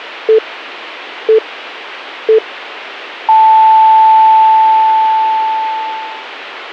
Radio time signal (three low pips and a long one an octave up, as on NHK), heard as pips.